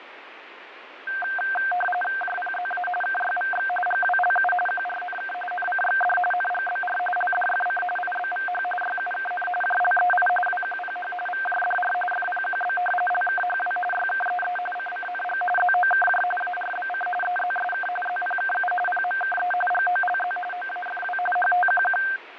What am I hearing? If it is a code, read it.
RTTY (45.45 baud, 850 Hz shift), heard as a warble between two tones, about 1140 Hz centre, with radio static and fading. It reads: JPZA KYVX GWLU QRNK NCXD NGBR LDFC IBVH YUKN JLEI WQPH VJDR FPQB LKHW YKEE CCNG ZOKJ ARBC EZSK ZPKU PMKE GOLZ OAFW HTQQ